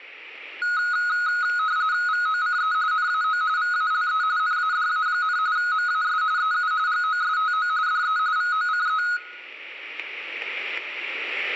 RTTY (45.45 baud, 170 Hz shift), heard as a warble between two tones, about 1360 Hz centre, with static crashes and room echo. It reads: VOCE NAO VALE NADA, MAS EU GOSTO DE VOCE